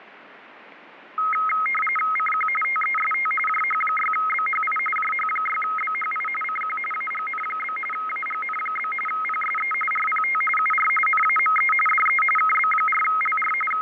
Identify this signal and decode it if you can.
RTTY (45.45 baud, 850 Hz shift), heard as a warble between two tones, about 1700 Hz centre, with radio static and fading. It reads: CQ TEST JH6BHI JH6BHI CQ AGN? AGN? PSE RPT UR NAME DE KB4LR …